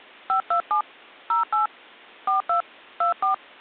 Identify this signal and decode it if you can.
DTMF, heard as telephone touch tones, dialled by hand, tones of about 120 ms. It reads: 527 08 42 24